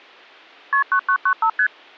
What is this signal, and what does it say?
Multi-frequency trunk signalling (R1, as on North American trunks), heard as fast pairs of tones, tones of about 80 ms. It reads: KP 9995 ST